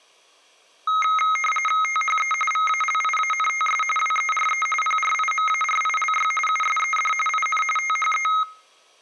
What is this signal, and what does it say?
RTTY (45.45 baud, 850 Hz shift), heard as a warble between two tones, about 1700 Hz centre. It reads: THE VALIANTS WERE PRIMARILY USED IN THE